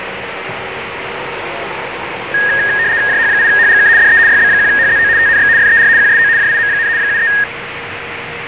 RTTY (75 baud, 170 Hz shift), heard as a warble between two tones, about 1750 Hz centre, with radio static, a steady whistle near 470 Hz and the noise of a residential street. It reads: JH8HGK DE YB1HZO TNX FER QSO JIM, 73